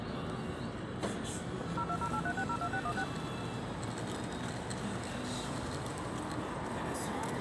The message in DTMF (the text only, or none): 02083602616